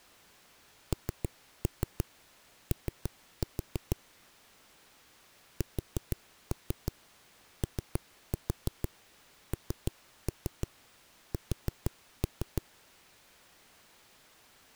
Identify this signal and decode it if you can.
Tap code, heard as knocks on a wall, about 6 knocks a second. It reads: NO SONS